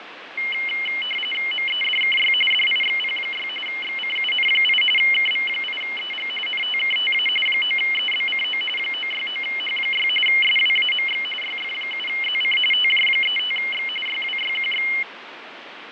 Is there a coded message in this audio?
Yes: RTTY (45.45 baud, 850 Hz shift) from 0.4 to 15.0 s, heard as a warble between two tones, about 2550 Hz centre, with radio static and fading. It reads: MEDKY DIXP6 XCUN8 KV8EG NTKTA 9EBCO 969H6 SWAMX YF7ZC TJ35X YWYQX